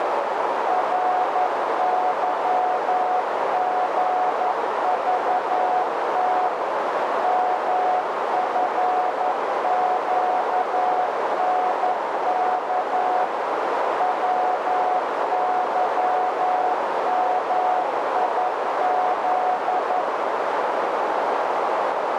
Morse code, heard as a keyed tone, machine-sent, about 11 wpm, 730 Hz, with heavy radio static and a narrow filter. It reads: RYGVT MFQNK WYMIZ